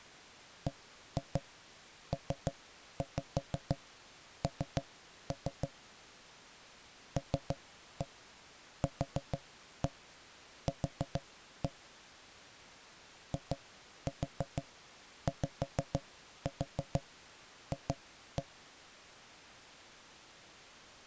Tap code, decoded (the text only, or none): BPN LQQ IYF